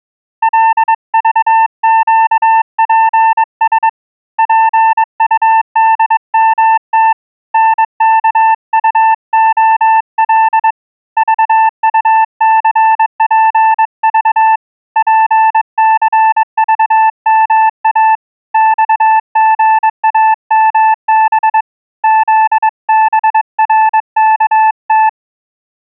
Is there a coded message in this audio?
Yes: Morse code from 0.4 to 25.2 s, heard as a keyed tone, hand-sent with a paddle, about 22 wpm, 880 Hz. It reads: LVQPS PUDMT NKUOL VUCPV PCVMA XGAMB ZBRKT